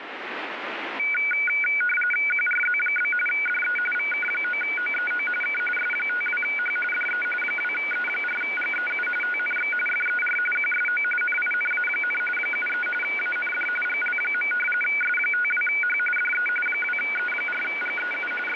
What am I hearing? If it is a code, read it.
RTTY (45.45 baud, 850 Hz shift), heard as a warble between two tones, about 1900 Hz centre, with radio static. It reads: QRZ? DE VK9OEO K S52H DE 2E4GEU TNX FER QSO NINA, 73 AND GL. S52H DE 2E4GEU …